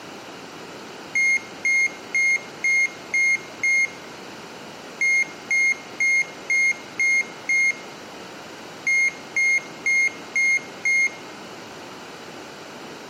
Beep code, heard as a piezo beeper, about 2150 Hz, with room echo. 6-6-5.